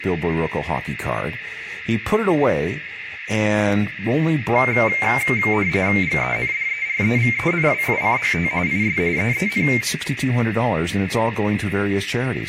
RTTY (45.45 baud, 170 Hz shift), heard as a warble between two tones, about 2200 Hz centre, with radio static, a narrow filter, room echo and speech in English. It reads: GENDEREVENWICHT IS EEN